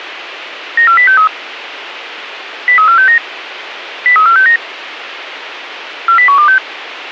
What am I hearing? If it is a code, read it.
Five-tone selective call (CCIR), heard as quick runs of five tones, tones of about 100 ms, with radio hiss. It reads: 94063 03469 03469 40126